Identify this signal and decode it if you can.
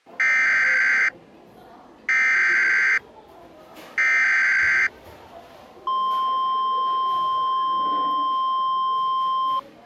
Emergency Alert System (SAME) tones (header bursts, then the 1050 Hz attention tone), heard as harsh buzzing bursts, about 520.83 baud, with the noise of a cafe.